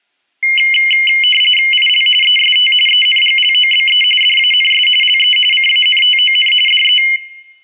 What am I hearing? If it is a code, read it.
RTTY (45.45 baud, 850 Hz shift), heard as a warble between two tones, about 2550 Hz centre. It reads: IL EST ENGLOBE DANS LE CANTON DE